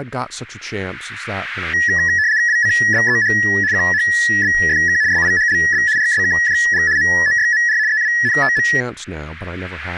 RTTY (75 baud, 170 Hz shift), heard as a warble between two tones, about 1800 Hz centre, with speech in English. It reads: WCBEH QHBFK SIHLB RSKJG MOYMR EWNTM